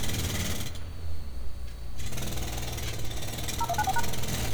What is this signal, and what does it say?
DTMF, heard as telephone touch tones, dialled by machine, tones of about 40 ms, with street noise. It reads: 0194#